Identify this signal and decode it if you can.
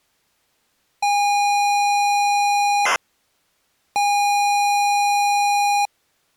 ZX Spectrum tape loading, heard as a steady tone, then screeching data.